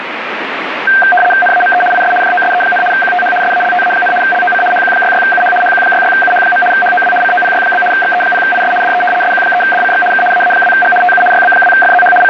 RTTY (75 baud, 850 Hz shift), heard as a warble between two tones, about 1140 Hz centre, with radio static. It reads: NAME IS JOSE, QTH SALTA, LOC HQ66UH HQ66UH. HOW COPY? XE0IS DE SQ3DCX K AA2G TU YB2FZH …